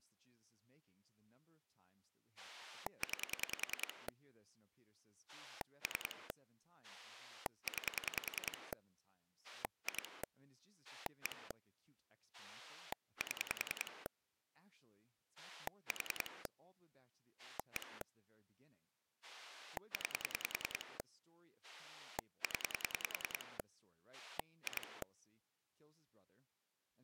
Pulse dialling, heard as a rotary dial, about 10 pulses a second, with speech in English. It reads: 9 3 9 2 1 7 4 1 9 0 2